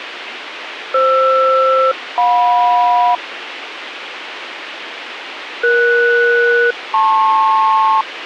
Aircraft SELCAL, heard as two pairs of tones, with radio hiss. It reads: FR-JM ES-LP